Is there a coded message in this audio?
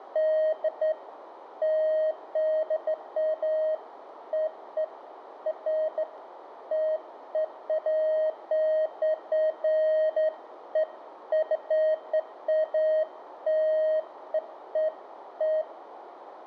No, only beeps of irregular length, with radio static and room echo.